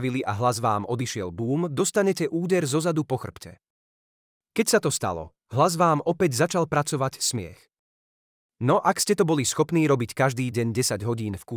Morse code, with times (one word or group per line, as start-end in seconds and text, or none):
none